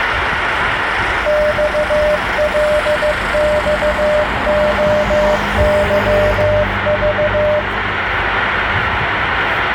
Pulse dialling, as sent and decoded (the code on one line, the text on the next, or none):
none